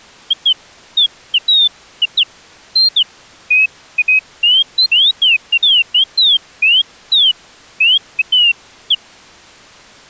Bird-like chirps. There is no code.